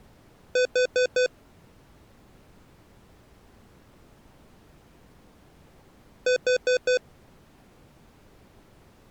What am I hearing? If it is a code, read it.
Alarm pattern, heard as an alarm's beeps, played twice, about 500 Hz. Temporal four. Carbon monoxide.